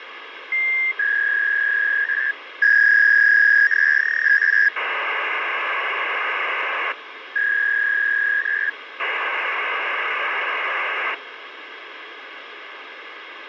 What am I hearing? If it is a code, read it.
Fax machine handshake, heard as a warble and hiss, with phone line noise.